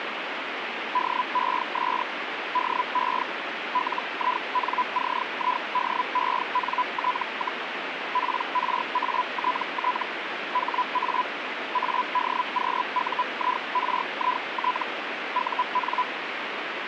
Hellschreiber (Feld-Hell, 122.5 baud), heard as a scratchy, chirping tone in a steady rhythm, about 1000 Hz, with radio static. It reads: DES DE LINCIDENT, PRATT HA ADQUIRIT UN